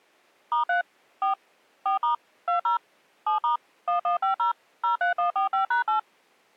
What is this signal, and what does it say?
DTMF, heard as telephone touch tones, dialled by machine, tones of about 120 ms. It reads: *3 4 4* 20 7* 1150 03145#8